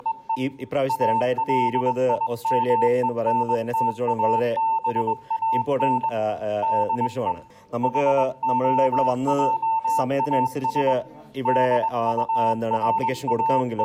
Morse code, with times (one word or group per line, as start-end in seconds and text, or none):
0.0-0.4 …
0.9-6.1 ALIMENTABAN
6.6-7.3 DE
7.8-10.9 HOJAS
11.5-13.8 …